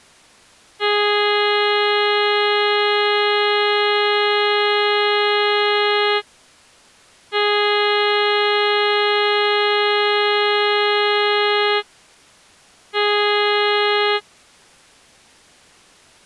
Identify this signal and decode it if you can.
Ship horn signal, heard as a ship's horn, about 420 Hz. 2 long, 1 short. At sea: I intend to overtake on your starboard side.